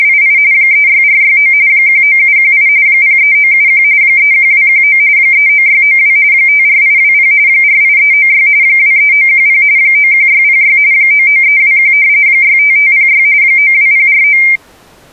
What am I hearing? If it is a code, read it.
RTTY (45.45 baud, 170 Hz shift), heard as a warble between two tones, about 2200 Hz centre. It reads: … 36469 19718 03971 31219 39692 54820 48396 23910 91606 99321 65506 92049